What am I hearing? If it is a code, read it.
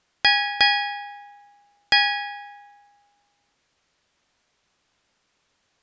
Ship's bell, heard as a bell. 3. Three half-hours of the watch have passed.